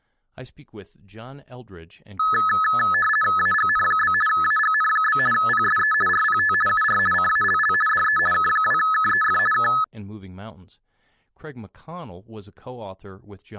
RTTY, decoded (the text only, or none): AGN? AGN? PSE RPT UR CALL DE K2KEF K